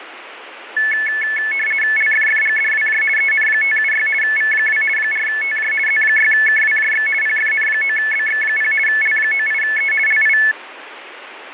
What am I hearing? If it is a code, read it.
RTTY (50 baud, 450 Hz shift), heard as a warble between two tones, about 1950 Hz centre, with radio static. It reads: LFFGDWJ EN576 V2 4TJ Z6KWJX PFN9BX0 L98E LI